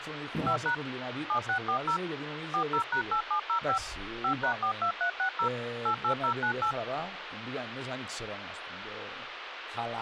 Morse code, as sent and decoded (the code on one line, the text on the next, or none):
none